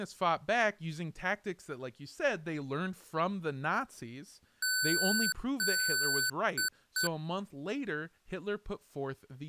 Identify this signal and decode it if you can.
Beep code, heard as beeps from a small speaker, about 1500 Hz, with speech in English. 2 long, 2 short.